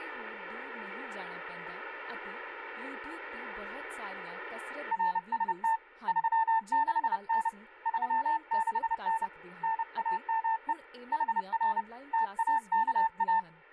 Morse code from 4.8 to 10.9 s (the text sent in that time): RST 36N 36N NAME